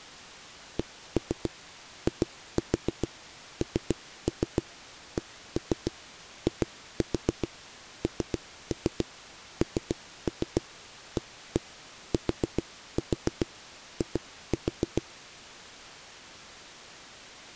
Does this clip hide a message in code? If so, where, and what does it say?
Yes: tap code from 0.8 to 15.0 s, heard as knocks on a wall, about 7 knocks a second. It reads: CINCINNATI